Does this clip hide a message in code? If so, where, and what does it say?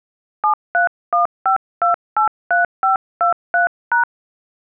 Yes: DTMF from 0.4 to 4.0 s, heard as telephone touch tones, dialled by hand, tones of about 120 ms. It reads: 7315283523#